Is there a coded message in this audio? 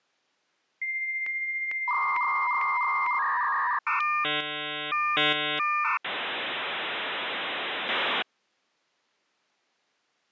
Yes: dial-up modem handshake (V.34 or later) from 0.8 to 8.2 s, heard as a whistle, warbles, then hiss.